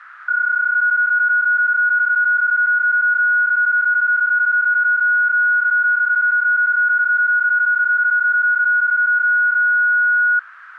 PSK31 (31.25 baud), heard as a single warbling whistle, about 1450 Hz.